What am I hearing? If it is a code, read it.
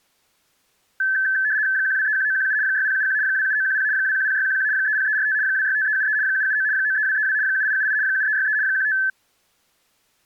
RTTY (75 baud, 170 Hz shift), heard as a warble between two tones, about 1650 Hz centre. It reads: 1231917 6071 27910 210611 30345 265373 779 93232 7878 7363 15